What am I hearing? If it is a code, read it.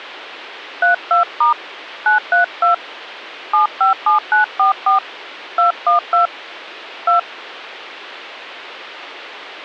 DTMF, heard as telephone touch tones, dialled by hand, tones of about 130 ms. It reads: 32* 932 757944 212 2